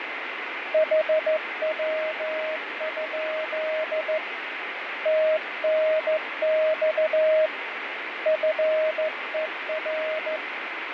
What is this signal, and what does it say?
Morse code, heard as a keyed tone, hand-sent with a straight key, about 14 wpm, 630 Hz, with radio static and fading. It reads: HW? TNX FER